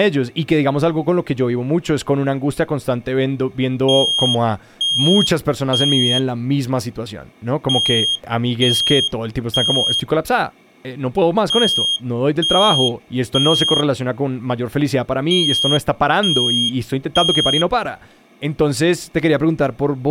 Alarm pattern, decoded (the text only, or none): temporal three